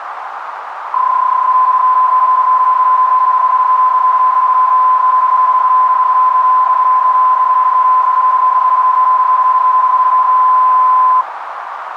PSK31 (31.25 baud), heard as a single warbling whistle, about 1020 Hz, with radio static and a narrow filter.